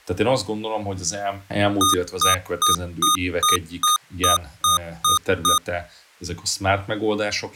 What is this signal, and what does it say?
Beep code, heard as beeps from a small speaker, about 1230 Hz, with speech in Hungarian. 10 short. In AMI BIOS tables: CMOS shutdown register error.